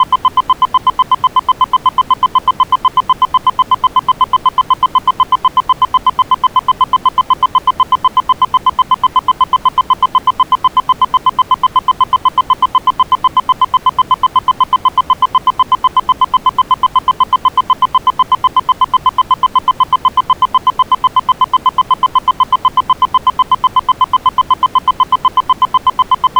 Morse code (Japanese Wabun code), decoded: none

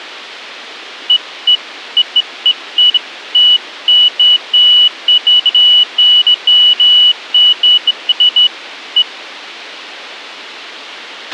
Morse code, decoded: none

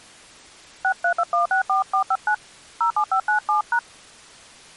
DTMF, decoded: 632164459 07597#

